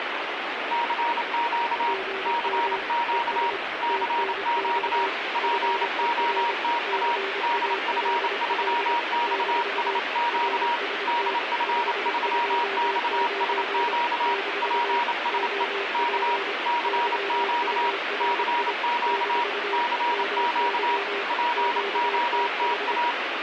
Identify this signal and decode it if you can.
Morse code, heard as two keyed tones, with radio static. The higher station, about 28 wpm, 950 Hz: CQ CQ CQ POTA DF3XSQ DF3XSQ PSE K CQ CQ CQ POTA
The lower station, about 25 wpm, 390 Hz: GM ES TNX FER CALL - RST 529 - OP YURI - MY QTH